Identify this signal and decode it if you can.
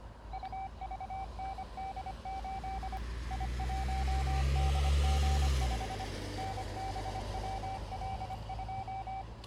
Morse code, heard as a keyed tone, machine-sent, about 25 wpm, 770 Hz, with the noise of a residential street. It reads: UVND8 I1DG5 NBWL2